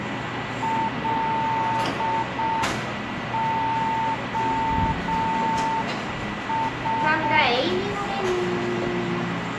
Morse code, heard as a keyed tone, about 6 wpm, 900 Hz, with radio static, a steady whistle near 1970 Hz and the noise of a cafe. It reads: LOS